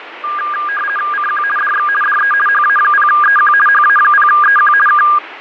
RTTY (50 baud, 450 Hz shift), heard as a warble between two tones, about 1420 Hz centre, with radio static and fading. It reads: CQ DX DE HA0EQ HA0EQ K